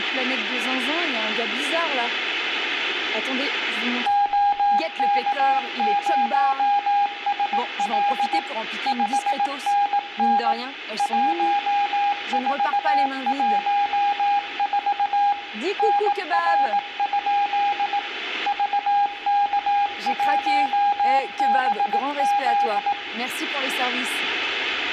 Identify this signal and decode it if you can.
Morse code, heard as a keyed tone, machine-sent, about 18 wpm, 810 Hz, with radio static and room echo. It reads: OK0SL 5NN 1414 NR? VK1BZ